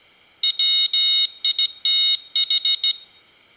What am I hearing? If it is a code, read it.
Morse code, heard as a high beeper, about 16 wpm, 3750 Hz, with room echo. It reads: WITH